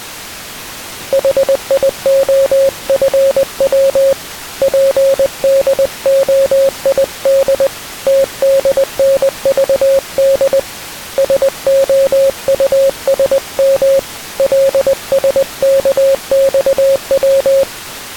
Morse code, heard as a keyed tone, hand-sent with a paddle, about 20 wpm, 540 Hz. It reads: HIOFW PDOID TDNVD SOUSM LSKXW